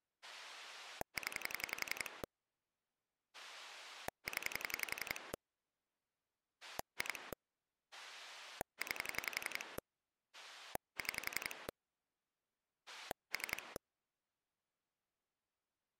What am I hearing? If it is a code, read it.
Pulse dialling, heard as a rotary dial, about 11 pulses a second. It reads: 0 0 2 9 6 3